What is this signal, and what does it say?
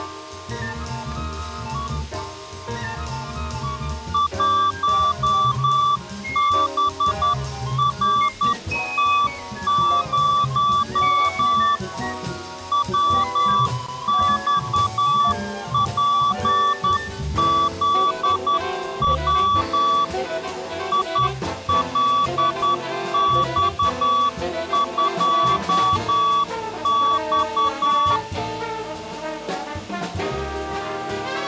Morse code, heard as a keyed tone, hand-sent with a straight key, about 10 wpm, 1150 Hz. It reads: 1BRT0 WXPZW ILX2X